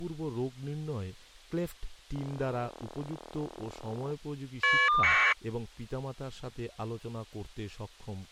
Caller ID data burst, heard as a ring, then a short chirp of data, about 1200 baud, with speech in Bangla.